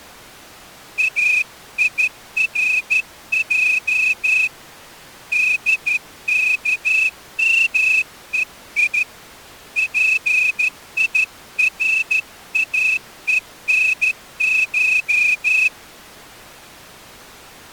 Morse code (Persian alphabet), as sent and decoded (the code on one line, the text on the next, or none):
.- .. .-. .--- / -.. -.- -- . .. / .--. .. .-. .- . -. ----
ایرج دکمهی پیراهنش